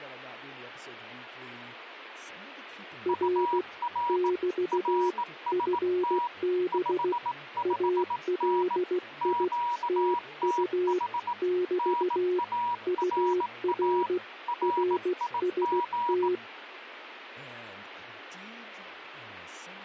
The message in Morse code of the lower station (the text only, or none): R <BT> FB ALI TU <BT> UR RST